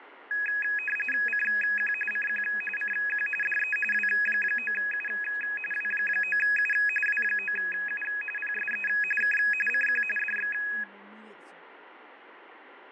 RTTY (45.45 baud, 850 Hz shift), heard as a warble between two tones, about 2100 Hz centre, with fading and speech in English. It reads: CQ CQ CQ DE W9U W9U W9U PSE K CQ DX